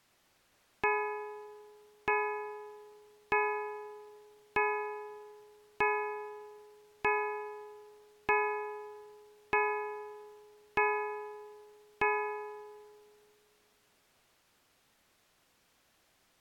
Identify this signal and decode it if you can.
Clock strike, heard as a bell. 10. Ten o'clock.